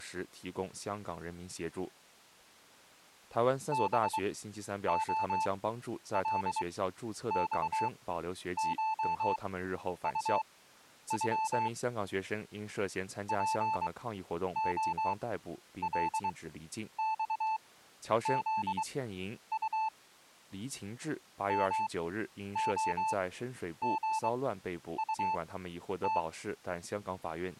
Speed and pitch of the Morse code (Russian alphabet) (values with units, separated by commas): 23 wpm, spaced as for 10 wpm, 880 Hz